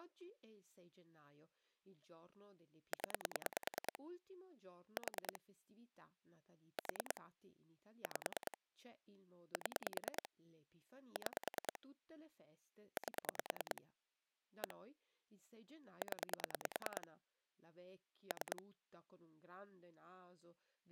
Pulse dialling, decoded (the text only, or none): 0 4 4 5 7 6 8 1 0 3